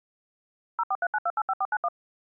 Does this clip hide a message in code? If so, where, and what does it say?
Yes: DTMF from 0.8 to 1.9 s, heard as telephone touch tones, dialled by machine, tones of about 50 ms. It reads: 0439285491